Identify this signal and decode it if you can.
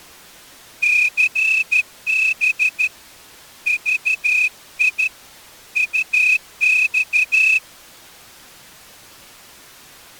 Morse code, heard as a whistle, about 13 wpm. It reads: CB VI UX